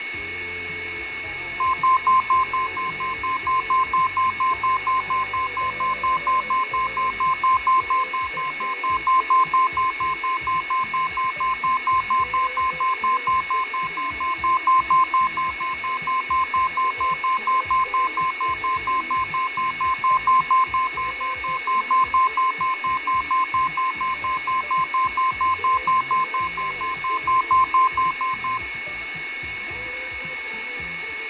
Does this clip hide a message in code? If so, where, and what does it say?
No, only evenly repeated beeps, with radio static, fading, a steady whistle near 2200 Hz and room echo.